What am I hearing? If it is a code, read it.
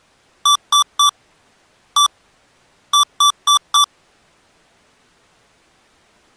Beep code, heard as beeps from a small speaker, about 1160 Hz. 3-1-4. In Phoenix BIOS tables: interrupt mask register failure.